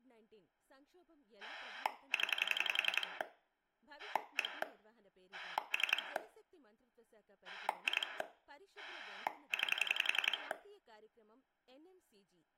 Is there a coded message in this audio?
Yes: pulse dialling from 1.4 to 10.5 s, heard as a rotary dial, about 11 pulses a second, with room echo and speech in Telugu. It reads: 0 1 3 2 9